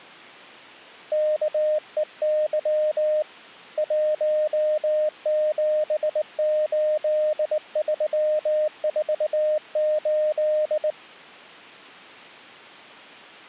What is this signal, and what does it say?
Morse code, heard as a keyed tone, hand-sent with a straight key, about 19 wpm, 610 Hz. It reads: KEY 178348